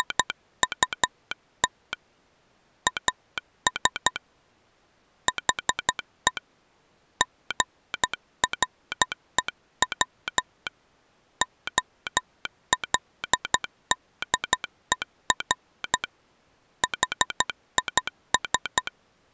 Morse code, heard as a telegraph sounder, hand-sent with a straight key, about 12 wpm. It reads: … AS HE GREW OLDER HIS